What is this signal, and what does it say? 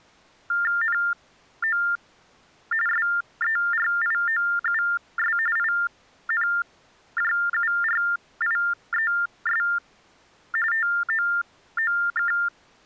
TTY/TDD text telephone tones (45.45 baud Baudot), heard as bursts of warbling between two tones, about 400 Hz shift, 1600 Hz centre. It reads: NO SERIOUS INJURIES TOOK